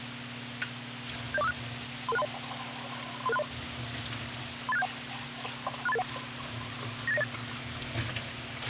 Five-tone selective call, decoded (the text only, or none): 70456 33630 33630 38671 63881 98908